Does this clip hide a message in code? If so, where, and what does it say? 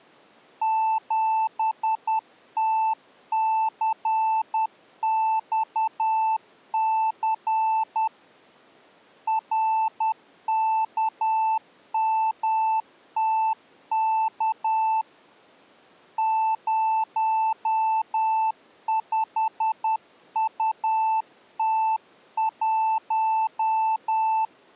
Yes: Morse code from 0.6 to 24.5 s, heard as a keyed tone, hand-sent with a paddle, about 10 wpm, 880 Hz. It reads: 7TCXC RKMTK 05UT1